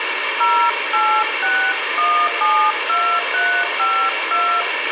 DTMF, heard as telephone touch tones, dialled by hand, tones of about 300 ms, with radio hiss, a squelch burst at the end and room echo. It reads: 086172352